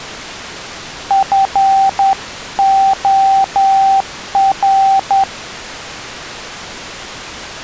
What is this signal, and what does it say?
Morse code, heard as a keyed tone, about 10 wpm, 780 Hz. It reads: FOR